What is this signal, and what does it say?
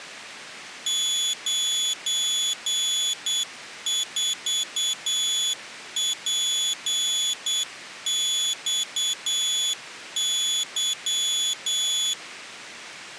Morse code, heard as a high beeper, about 8 wpm, 3400 Hz. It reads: 94PXY